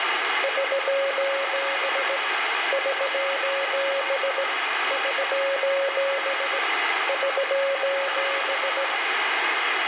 Morse code, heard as a keyed tone, hand-sent with a straight key, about 17 wpm, 550 Hz, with radio static and room echo. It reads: <SOS> <SOS> <SOS> <SOS>